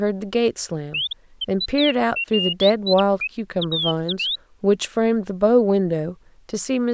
Bird-like chirps, with speech in English. There is no code.